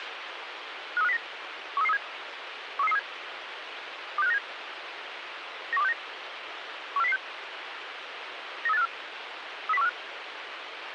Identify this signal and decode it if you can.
Five-tone selective call (EEA), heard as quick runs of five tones, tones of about 40 ms, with radio hiss. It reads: 53509 13337 13337 26597 91269 14006 93854 30145